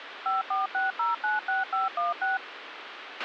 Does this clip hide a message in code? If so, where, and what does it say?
Yes: DTMF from 0.3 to 2.4 s, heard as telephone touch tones, dialled by machine, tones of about 160 ms, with radio hiss and a squelch burst at the end. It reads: 546096516